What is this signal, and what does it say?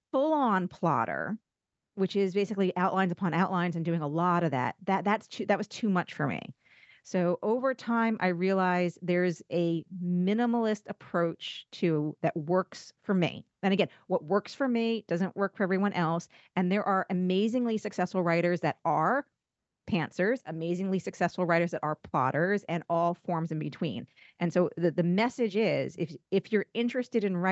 Speech in English. There is no code.